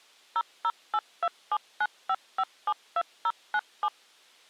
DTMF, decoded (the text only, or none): 0082795572097